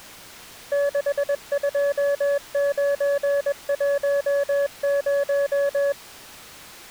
Morse code, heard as a keyed tone, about 21 wpm, 570 Hz. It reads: 62910